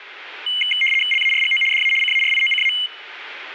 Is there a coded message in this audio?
Yes: RTTY (75 baud, 850 Hz shift) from 0.5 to 2.9 s, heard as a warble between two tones, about 2550 Hz centre. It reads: LARGO DA CARIOCA